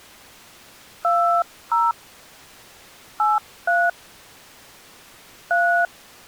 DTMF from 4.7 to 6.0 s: 3

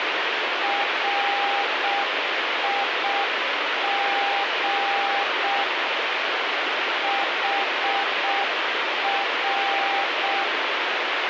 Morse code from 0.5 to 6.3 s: RIG

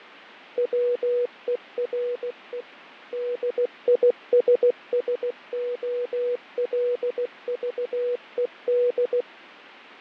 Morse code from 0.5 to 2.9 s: WERE

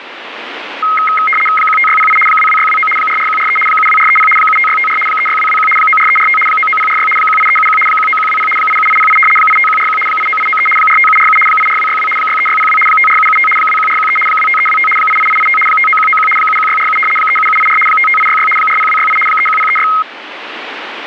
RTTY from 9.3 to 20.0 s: 85141 89893 45747 84262 63602 54775 21413 25325 88885 59191 71647 37784 55866 40268 31036

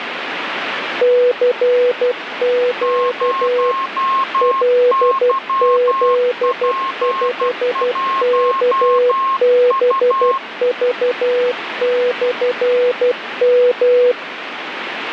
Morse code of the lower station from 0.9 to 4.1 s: CQ

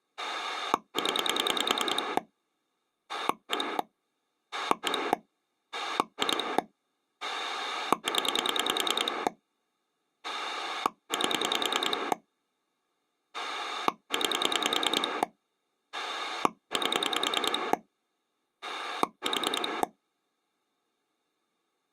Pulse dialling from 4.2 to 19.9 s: 1 2 0 8 9 8 4

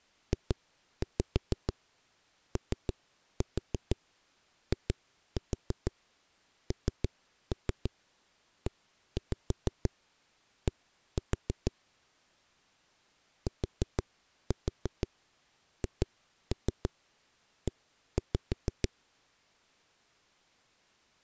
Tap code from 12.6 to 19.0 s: THE

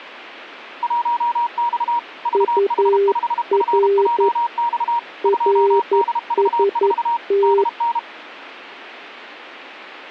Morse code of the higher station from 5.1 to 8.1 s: 2DV4 DN

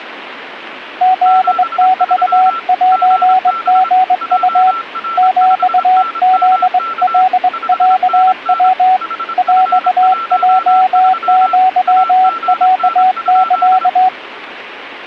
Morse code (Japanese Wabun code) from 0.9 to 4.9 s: フメセリウ

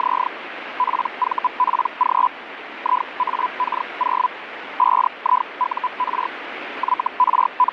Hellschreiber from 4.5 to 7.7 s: 5IUR …

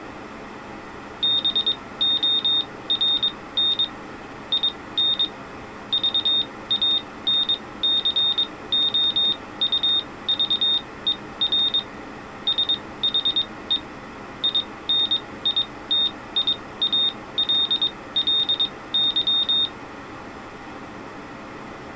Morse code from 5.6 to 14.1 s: VANCOUVER SHE

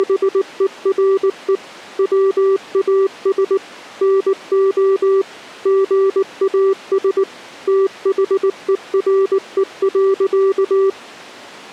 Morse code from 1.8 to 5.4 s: WAS NO

